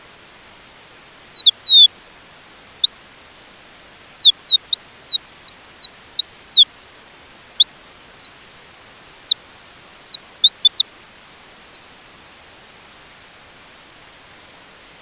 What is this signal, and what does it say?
Bird-like chirps. There is no code.